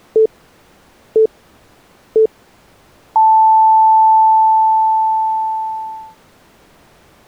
Radio time signal (three low pips and a long one an octave up, as on NHK), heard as pips.